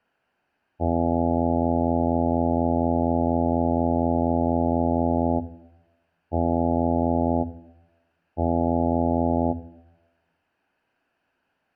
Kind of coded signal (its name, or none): ship horn signal